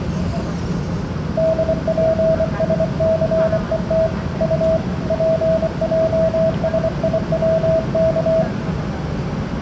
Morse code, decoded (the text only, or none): DPSCET U PJSIWK